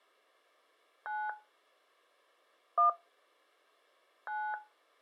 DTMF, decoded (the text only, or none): 9 1 9